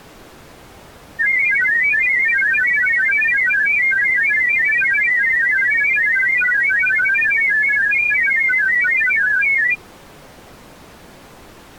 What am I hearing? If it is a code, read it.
Multi-tone FSK (Olivia or MFSK type), about 1000 Hz wide, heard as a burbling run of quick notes, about 31.25 baud.